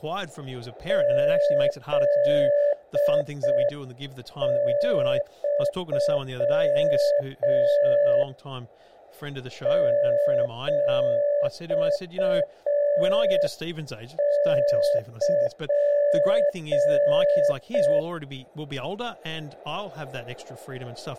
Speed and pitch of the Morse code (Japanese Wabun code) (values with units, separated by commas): 5 wpm, 580 Hz